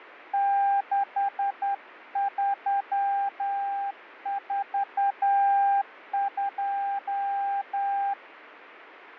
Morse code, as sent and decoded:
-.... ...-- ....- ..---
6342

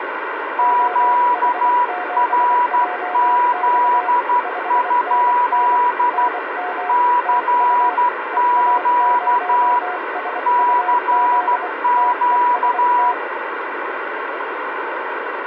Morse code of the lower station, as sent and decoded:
--- .... --... .--- -..- / ..... -. -. / -. -- / - ..- / . .- ----- ... ..- --.. / - . ... -
OH7JX 5NN NM TU EA0SUZ TEST

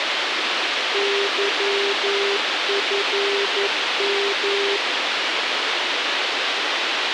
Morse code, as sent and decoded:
-.-- ..-. --
YFM

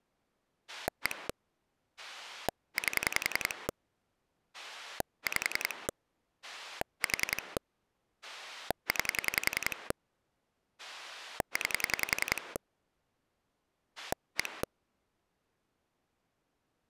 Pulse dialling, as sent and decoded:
1 / 8 / 5 / 4 / 9 / 9 / 1
1 8 5 4 9 9 1

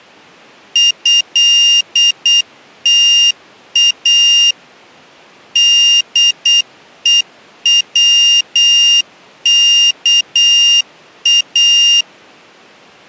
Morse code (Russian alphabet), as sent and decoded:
..-.. - .- / -.. . .-- -.- .-
ЭТА ДЕВКА

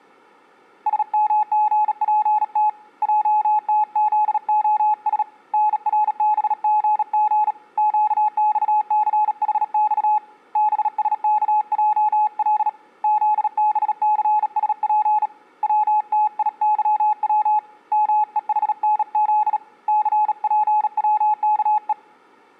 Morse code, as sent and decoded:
... -- --. .--. - / .--- - --.. --- ... / -. .-. -... --. --. / --.- -..- -.-. .... -..- / -... ... -.- .--- .-.. / --.. -... -.-. ... .--. / .-- - .. -.-- .-- / -- . .... -. --.. / -.-. .--. .-- -.- .
SMGPT JTZOS NRBGG QXCHX BSKJL ZBCSP WTIYW MEHNZ CPWKE

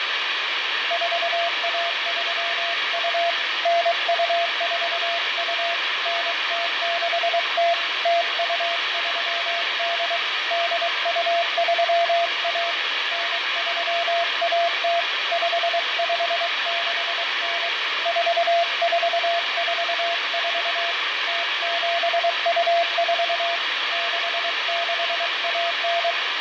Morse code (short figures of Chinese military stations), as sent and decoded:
....- .- ...-- ..- / -. ..- ....- ..- / -. - -.... - / - ..- ...-- -.. / -.. ..- ...-- .- / -. ...-- .- - / ..... ..... -.... -. / ....- ....- ....- ....- / - --... ..- ....- / -.... -.... .- -.
4132 9242 9060 0238 8231 9310 5569 4444 0724 6619

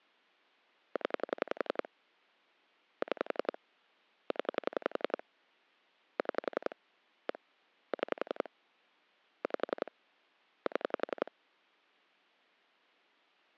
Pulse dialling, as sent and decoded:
10 / 6 / 10 / 6 / 1 / 6 / 5 / 7
0 6 0 6 1 6 5 7

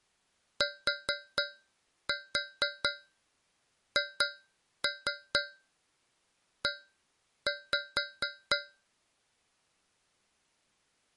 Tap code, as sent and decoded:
4-4 2-3 1-5
THE

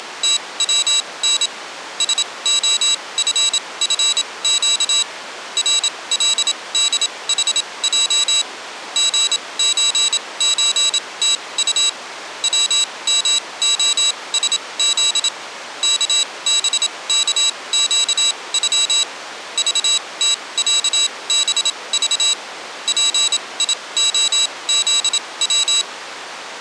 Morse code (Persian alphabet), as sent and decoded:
… / ... --- ..-. ..-. --.- / .-. .-.. -.. .... .--- / --. ---. ---. - ..- / .-- -- --- ... --.. / -.- -... -.- --.- ..-- / ...- - .-.- -... ...- / .--. .. --- --.. .--
… سعففگ رلدحج ژچچتط ومعسز کبکگغ ذتصبذ پیعزو

